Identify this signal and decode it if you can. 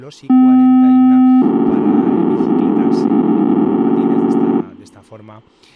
POCSAG pager data (512 baud), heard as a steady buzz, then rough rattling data, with a squelch burst at the end.